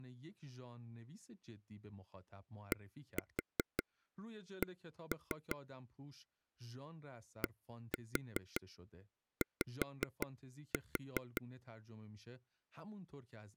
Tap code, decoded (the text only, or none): DC DY